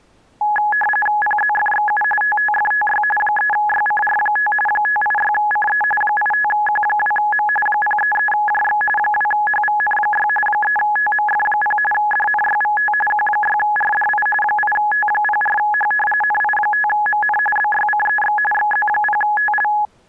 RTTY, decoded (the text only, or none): PZFXU TTFTY 3YCR5 586CE 85Q2M 033JX 2HVN6 3TMF0 DNYVT Q6RDI 8T04H NI5MN BYCEX XZ0TL